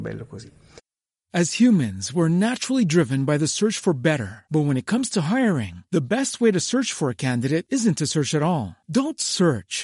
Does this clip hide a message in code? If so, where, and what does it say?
No, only speech in Italian.